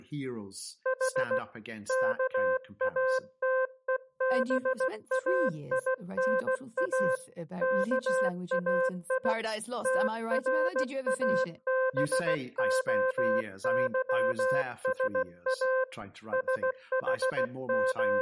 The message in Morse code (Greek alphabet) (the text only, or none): Η ΚΑΤΕΒΑΙΝΑ ΚΑΙ ΤΡΑΒΟΥΣΑ …